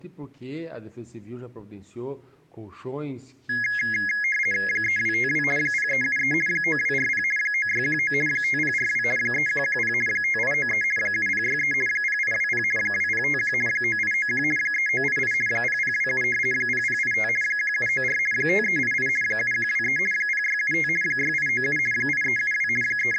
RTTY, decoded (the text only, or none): 3252 0373 9240 9619 5042 3110 5893 7063 0820 2051 9891 3988 0027 0085 1794 5388 7123 0675 6897 8372 …